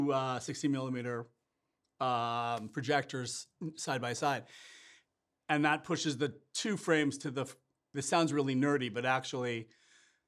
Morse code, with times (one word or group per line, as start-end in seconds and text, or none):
none